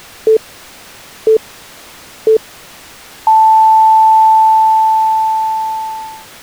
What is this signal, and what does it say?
Radio time signal (three low pips and a long one an octave up, as on NHK), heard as pips.